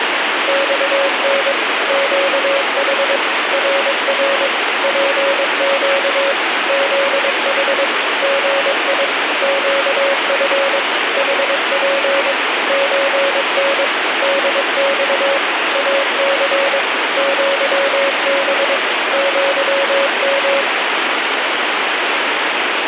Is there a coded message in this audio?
Yes: Morse code (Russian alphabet) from 0.4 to 20.7 s, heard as a keyed tone, machine-sent, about 22 wpm, 550 Hz, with heavy radio static. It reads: ЬН ЩХ РР ПЩ ЗХ ГИ ЩФ ХП ЧН ДЬ АЦ ЪБ ЪМ